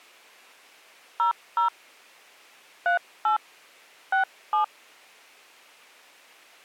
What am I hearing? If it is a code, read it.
DTMF, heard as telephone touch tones, dialled by hand, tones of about 120 ms. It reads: 00 38 67